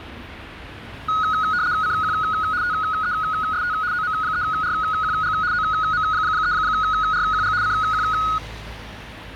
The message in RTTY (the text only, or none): CQ TEST OM3RQG OM3RQG CQ